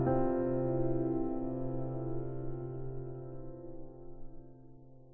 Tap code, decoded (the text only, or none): none